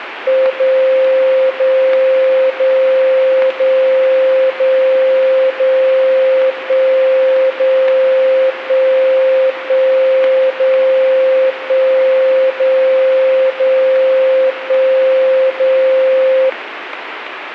Radio time signal (DCF77), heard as a tone whose level steps once a second, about 520 Hz, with radio static. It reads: 0 0 0 0 0 0 1 0 1 1 0 1 0 0 1 0